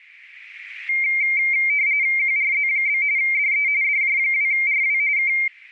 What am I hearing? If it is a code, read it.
RTTY (45.45 baud, 170 Hz shift), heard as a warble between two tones, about 2200 Hz centre. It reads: QRZ? DE DJ2RW K